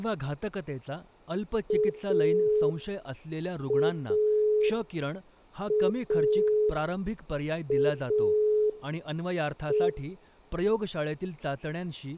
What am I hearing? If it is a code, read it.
Telephone call progress tone (pulsed, as in Italy), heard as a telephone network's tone, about 420 Hz, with room echo and speech in Marathi. Dial tone.